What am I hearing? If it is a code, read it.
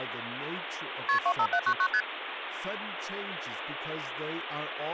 Multi-frequency trunk signalling (R1, as on North American trunks), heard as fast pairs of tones, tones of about 70 ms, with phone line noise and speech in English. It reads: KP 25799 ST